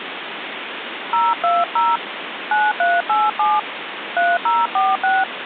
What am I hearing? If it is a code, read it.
DTMF, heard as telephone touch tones, dialled by hand, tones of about 200 ms, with phone line noise. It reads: 020 9387 3046